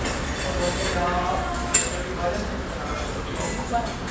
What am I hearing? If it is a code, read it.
The noise of a restaurant. There is no code.